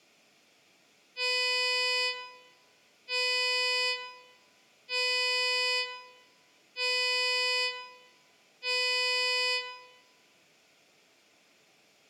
Ship horn signal, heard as a ship's horn, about 500 Hz, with room echo. 5 short. At sea: I doubt that you are doing enough to avoid a collision.